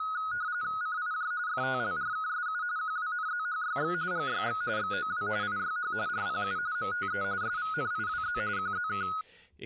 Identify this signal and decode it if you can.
RTTY (45.45 baud, 170 Hz shift), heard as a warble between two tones, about 1360 Hz centre, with speech in English. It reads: CIJ FTLRKSU QWNZHYX GYX XOW IYH RPU MTE SVNIWZ QZK